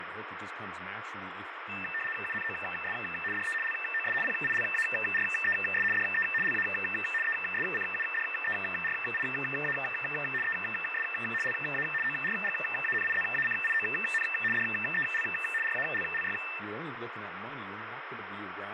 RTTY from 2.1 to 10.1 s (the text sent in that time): UNOS DE LOS PILARES DE LA ESCUDERIA